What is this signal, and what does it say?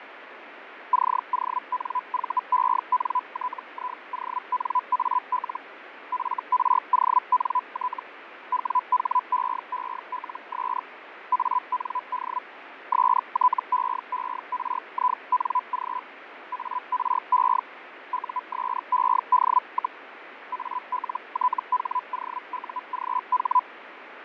Hellschreiber (Feld-Hell, 122.5 baud), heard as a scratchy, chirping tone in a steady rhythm, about 1000 Hz, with radio static and fading. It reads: CONVENTIONAL FRONT WHEELS AND STEERING ARE USED, ALTHOUGH